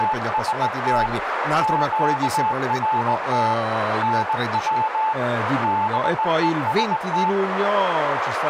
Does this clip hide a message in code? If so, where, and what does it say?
Yes: Morse code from 0.0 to 7.4 s, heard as a keyed tone, hand-sent with a straight key, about 19 wpm, 870 Hz, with radio static, a narrow filter and speech in Italian. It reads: … QRT NW BEST